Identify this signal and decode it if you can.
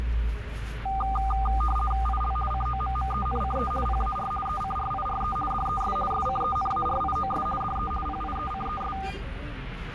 RTTY (50 baud, 450 Hz shift), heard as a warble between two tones, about 1000 Hz centre, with radio static and the noise inside a bus. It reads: IL COMMENCE PAR ECRIRE DES SCENARIOS DE PIECES